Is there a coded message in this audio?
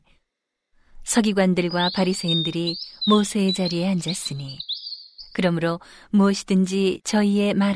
No, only bird-like chirps, with room echo and speech in Korean.